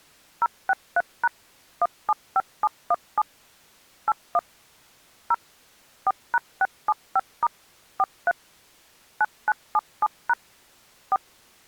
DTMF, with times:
0.4-1.3 063#
1.8-3.2 175717
4.1-4.4 81
5.3-5.3 0
6.1-7.5 4#675*
8.0-8.3 43
9.2-10.3 9977#
11.1-11.2 4

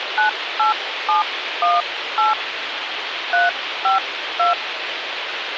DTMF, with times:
0.2-2.3 98718
3.3-4.5 352

